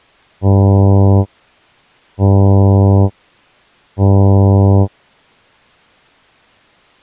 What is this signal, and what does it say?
Ship horn signal, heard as a ship's horn, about 100 Hz. 3 short. At sea: I am operating astern propulsion.